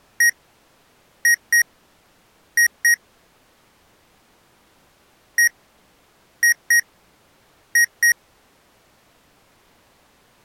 Beep code, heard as beeps from a small speaker, played twice, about 1900 Hz. 1-2-2. In Phoenix BIOS tables: DMA initialisation failure.